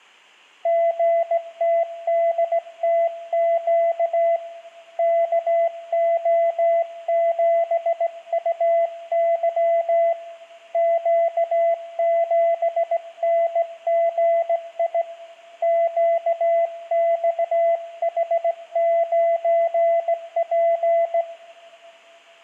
Morse code, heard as a keyed tone, hand-sent with a straight key, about 17 wpm, 670 Hz, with room echo. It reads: GTDTQ KO7UY Q7NGI QXH9P